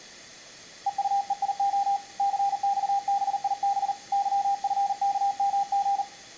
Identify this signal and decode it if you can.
Morse code, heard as a keyed tone, hand-sent with a paddle, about 39 wpm, 800 Hz, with room echo. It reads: EUEIO CXBIB YFKMG